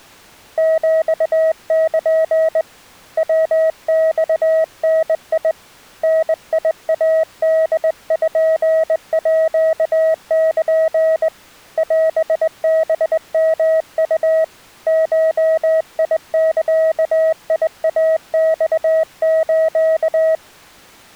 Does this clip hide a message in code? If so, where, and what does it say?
Yes: Morse code (Japanese Wabun code) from 0.5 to 20.4 s, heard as a keyed tone, hand-sent with a straight key, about 20 wpm, 640 Hz. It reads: ヒル ヤマダ ダイポール オハヨウ ゴザイマス